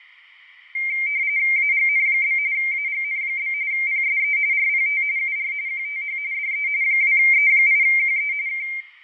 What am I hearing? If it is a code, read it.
RTTY (45.45 baud, 170 Hz shift), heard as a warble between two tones, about 2200 Hz centre, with radio static and fading. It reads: AGN? AGN? PSE RPT UR QTH DE 2E8QE K